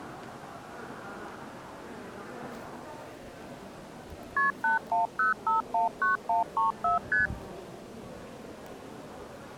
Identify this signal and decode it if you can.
Multi-frequency trunk signalling (R1, as on North American trunks), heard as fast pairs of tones, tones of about 140 ms, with the noise of a crowd indoors. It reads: KP 810519134 ST